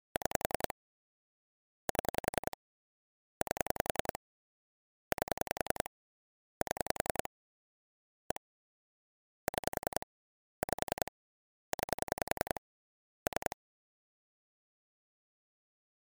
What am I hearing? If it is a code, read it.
Pulse dialling, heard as clicks on a phone line, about 10 pulses a second. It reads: 6 7 8 8 7 1 6 5 9 3